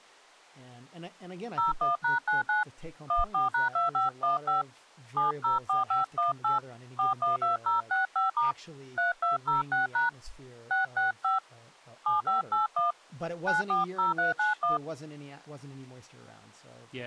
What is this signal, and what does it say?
DTMF, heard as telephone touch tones, dialled by hand, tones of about 140 ms, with speech in English. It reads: 01#99 14#2515 704518 412065* 3206# 665 7581 940391